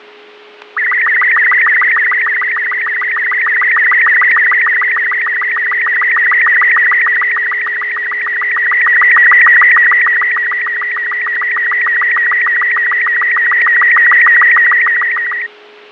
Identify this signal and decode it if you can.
SSTV (slow-scan television), Robot 36, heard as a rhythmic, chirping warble, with radio static, fading, static crashes and a steady whistle near 420 Hz.